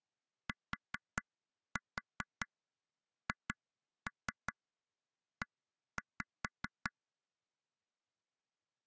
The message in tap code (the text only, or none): THE